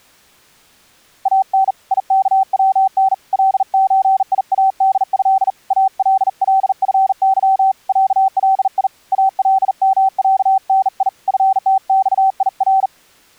Morse code (Arabic alphabet), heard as a keyed tone, hand-sent with a bug key, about 40 wpm, 770 Hz. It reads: ان يكون لزياده اللفظ علي المعني فتصير